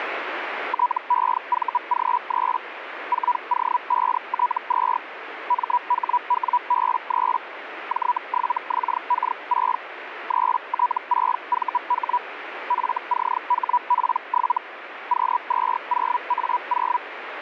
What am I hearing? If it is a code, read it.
Hellschreiber (Feld-Hell, 122.5 baud), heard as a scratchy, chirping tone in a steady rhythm, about 980 Hz, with radio static. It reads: TEVG3 4O5T2 MHWB3 J7XK6 3T6VH FCHP7 Q20A0